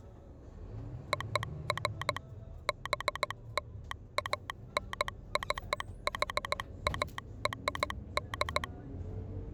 Morse code (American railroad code), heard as a telegraph sounder, machine-sent, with the noise inside a bus. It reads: OF BLANCHARD